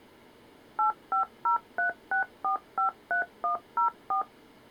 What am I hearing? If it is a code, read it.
DTMF, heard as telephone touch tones, dialled by machine, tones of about 110 ms. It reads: 85036453104